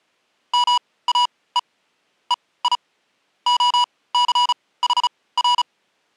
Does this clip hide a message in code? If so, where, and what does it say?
Yes: Morse code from 0.5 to 5.7 s, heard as electronic beeps, machine-sent, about 35 wpm, spaced as for 20 wpm, 980 Hz. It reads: MAE EI OCHR